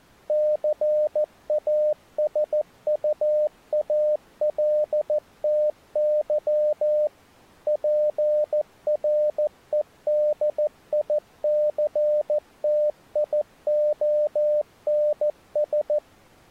Morse code, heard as a keyed tone, machine-sent, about 14 wpm, 600 Hz. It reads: CASUALTY PREDICTIONS